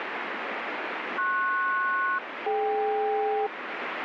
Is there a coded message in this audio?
Yes: aircraft SELCAL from 1.2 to 3.5 s, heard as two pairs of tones, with radio static. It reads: PS-DK